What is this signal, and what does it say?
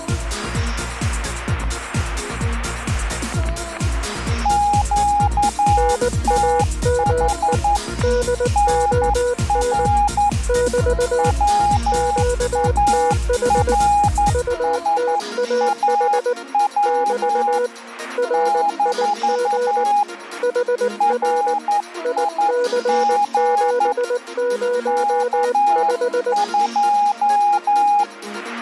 Morse code, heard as two keyed tones, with static crashes. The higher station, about 11 wpm, 820 Hz: QTH NR WARSAW - RIG K2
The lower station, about 19 wpm, 490 Hz: NAME DON <BT> QTH UTAH <BT> RIG HR IC705